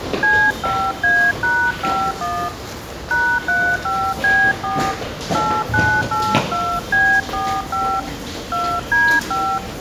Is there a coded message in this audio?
Yes: DTMF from 0.2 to 9.6 s, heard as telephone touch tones, dialled by hand, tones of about 280 ms, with the noise of a subway station. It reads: C5A#51 #35B4 8982B45 2D5